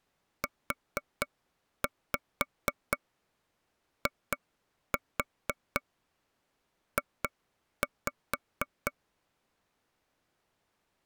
Tap code, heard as taps on a table, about 4 knocks a second. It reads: UIJ